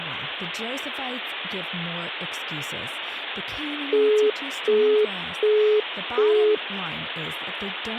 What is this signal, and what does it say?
Telephone call progress tone (as in the UK, Australia and similar networks), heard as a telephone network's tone, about 420 Hz, 0.375 s on and 0.375 s off, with speech in English. Busy tone.